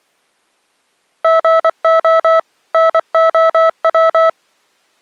Morse code, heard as electronic beeps, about 24 wpm, 650 Hz. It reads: GO NOW